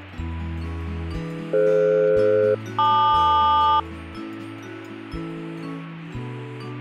Aircraft SELCAL, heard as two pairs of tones. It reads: DF-LQ